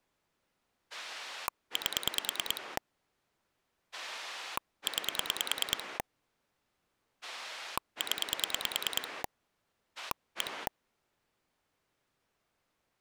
Pulse dialling, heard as a rotary dial, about 9 pulses a second. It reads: 8 9 0 1